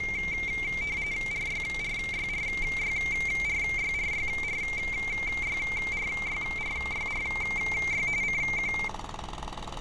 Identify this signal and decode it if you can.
RTTY (45.45 baud, 170 Hz shift), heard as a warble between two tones, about 2200 Hz centre, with street noise. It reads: RYRYRYRYRYRYRYRYRY CQ